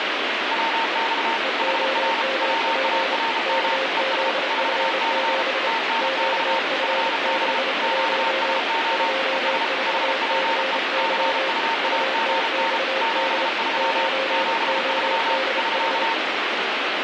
Morse code, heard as two keyed tones, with heavy radio static. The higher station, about 33 wpm, 910 Hz: WX HR WARM ES 4C TNX FB QSO ES HPE CUAGN 73 73 <SK>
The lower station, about 29 wpm, 530 Hz: EOMP KZF7 QF61 24CY UTXD 9ODH